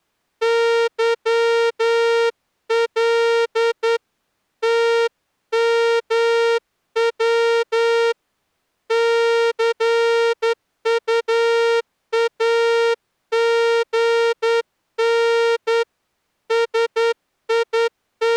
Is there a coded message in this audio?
Yes: Morse code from 0.4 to 18.4 s, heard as a horn, hand-sent with a straight key, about 10 wpm. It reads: YL TMW CUAGN …